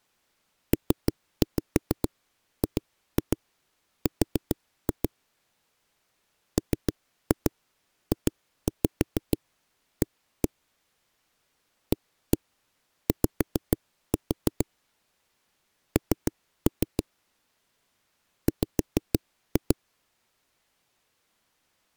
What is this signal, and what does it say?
Tap code, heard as knocks on a wall, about 6 knocks a second. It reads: PGR MJA AY N W